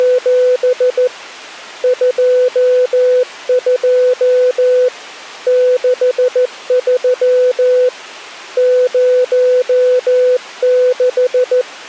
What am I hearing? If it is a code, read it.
Morse code, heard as a keyed tone, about 14 wpm, 500 Hz. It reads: … 22 63 06